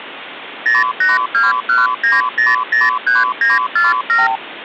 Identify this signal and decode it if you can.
Multi-frequency trunk signalling (R2, with the far end's replies), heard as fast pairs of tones, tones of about 170 ms, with phone line noise. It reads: 08219003947